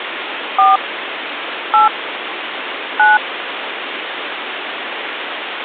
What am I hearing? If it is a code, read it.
DTMF, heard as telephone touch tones, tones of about 150 ms, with phone line noise. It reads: 4 8 9